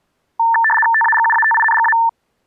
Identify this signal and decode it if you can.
RTTY (75 baud, 850 Hz shift), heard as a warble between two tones, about 1340 Hz centre. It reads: TAGUATINGA